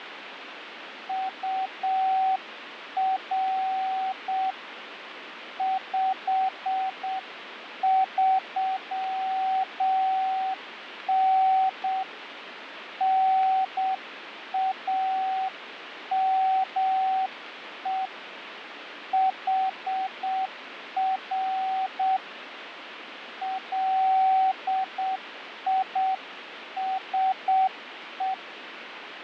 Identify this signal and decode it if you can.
Morse code, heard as a keyed tone, hand-sent with a straight key, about 7 wpm, 760 Hz, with radio static and fading. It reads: UR 53N NAME HR LISE